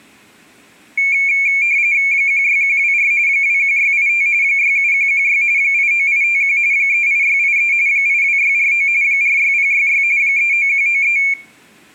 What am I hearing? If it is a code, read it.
RTTY (45.45 baud, 170 Hz shift), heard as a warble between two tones, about 2300 Hz centre, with room echo. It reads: 16124 21685 67116 89851 38683 82649 46066 39193